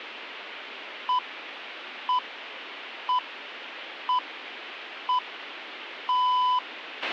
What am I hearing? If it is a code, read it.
Radio time signal (six pips, as the Greenwich Time Signal), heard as pips, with a squelch burst at the end.